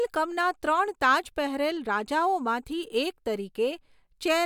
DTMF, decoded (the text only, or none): none